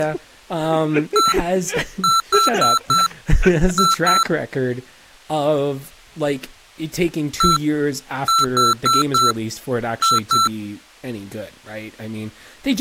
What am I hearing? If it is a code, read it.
Beep code, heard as beeps from a small speaker, played twice, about 1340 Hz, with speech in English. 1-4-2. In Phoenix BIOS tables: parity failure in the first 64 KB of memory.